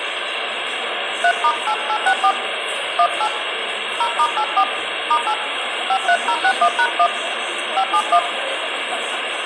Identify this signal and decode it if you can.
DTMF, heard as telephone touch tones, dialled by hand, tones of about 70 ms, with phone line noise, room echo and the noise of a subway station. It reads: 3*8864 18 0*84 *8 53061#1 571